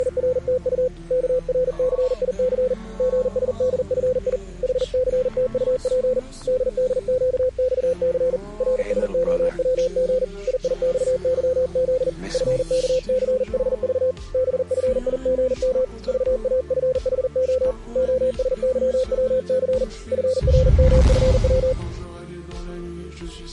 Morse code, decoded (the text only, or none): … KRCIC GSDFI HCTUP DDQXC RSOWG IIXYZ FKCHV BFIGM VAFHO OSYWC FRMFW